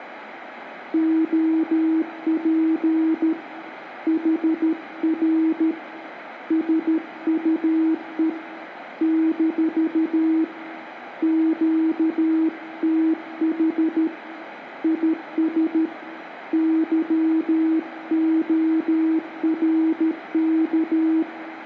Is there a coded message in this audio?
Yes: Morse code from 0.9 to 21.3 s, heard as a keyed tone, hand-sent with a paddle, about 13 wpm, 320 Hz, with room echo. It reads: OP HR SUE - QTH IS YORK